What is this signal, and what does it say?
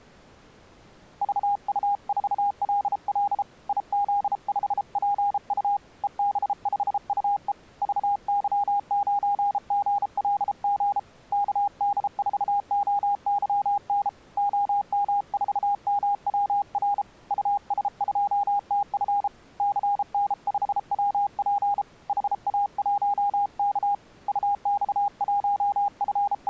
Morse code, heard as a keyed tone, hand-sent with a paddle, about 33 wpm, 810 Hz. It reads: VU4LL IZ5PU EB5UE VY9GLG KD4OYN OM4MWR US2TF CN5WP HA1K …